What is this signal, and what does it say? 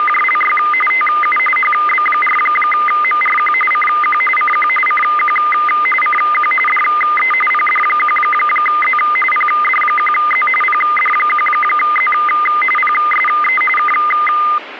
RTTY (45.45 baud, 850 Hz shift), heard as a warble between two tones, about 1650 Hz centre, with radio static. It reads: … TU HB4MRQ CQ CQ CQ CQ DE PD1Z PD1Z PD1Z PSE K